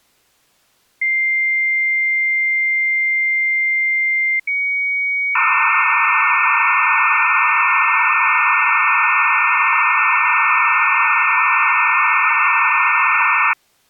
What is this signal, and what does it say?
Dial-up modem handshake (low-speed, two carriers), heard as two whistles, then hiss.